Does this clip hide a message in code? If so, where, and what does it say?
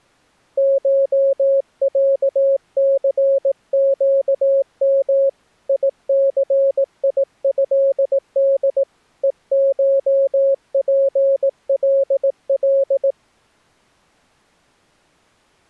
Yes: Morse code (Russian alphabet) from 0.5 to 13.2 s, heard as a keyed tone, hand-sent with a paddle, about 18 wpm, 550 Hz. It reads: ШЯЦЩМ ИЦИЭД ЕШПЛЛ